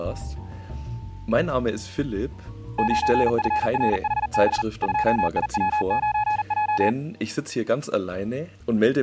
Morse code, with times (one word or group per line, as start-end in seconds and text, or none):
2.8-4.6 9FRHB
4.8-6.9 2IW9J